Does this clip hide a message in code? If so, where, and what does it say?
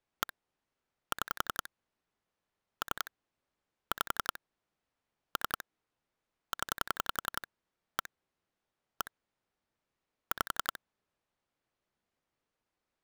Yes: pulse dialling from 0.2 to 10.8 s, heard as clicks on a phone line, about 11 pulses a second. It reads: 1 6 3 5 3 0 1 1 5